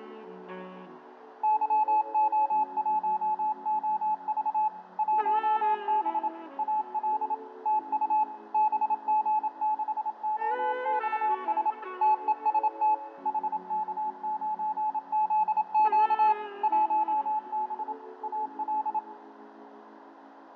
Morse code, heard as a keyed tone, machine-sent, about 27 wpm, 860 Hz, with radio static, fading, a narrow filter and room echo. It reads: YO1OV 1B AL TU BG6OXS TEST HK9ZQ 1B AL